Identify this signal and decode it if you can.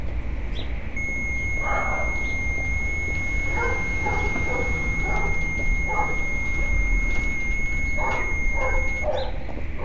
FT8 (one signal), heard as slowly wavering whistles, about 6.25 baud, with radio static and street noise.